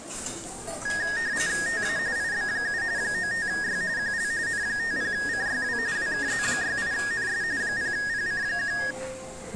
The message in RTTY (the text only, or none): TA IB7 95Y QL N50CYW WKZ68NS 0PC1